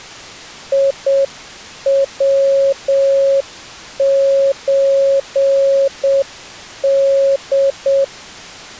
Morse code (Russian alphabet), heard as a keyed tone, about 7 wpm, 550 Hz. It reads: ИВЧД